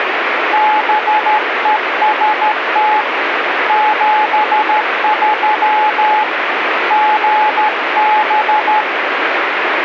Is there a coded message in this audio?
Yes: Morse code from 0.5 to 8.9 s, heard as a keyed tone, hand-sent with a straight key, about 13 wpm, 850 Hz, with radio static. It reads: BEST 73 GB